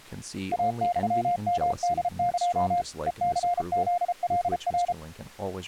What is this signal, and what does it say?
Morse code (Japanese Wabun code), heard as a keyed tone, machine-sent, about 33 wpm, 700 Hz, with speech in English. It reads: イユヨホエ ヘニフカナ